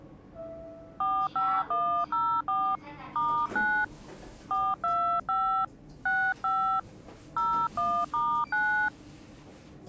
DTMF, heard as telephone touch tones, dialled by hand, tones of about 290 ms, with the noise inside a lift. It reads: 45104 *9 425 65 01*9